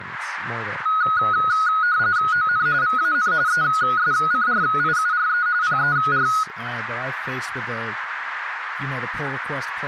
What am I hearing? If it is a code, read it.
RTTY (45.45 baud, 170 Hz shift), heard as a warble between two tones, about 1360 Hz centre, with radio static and speech in English. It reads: ON VAN ESCRIURE PER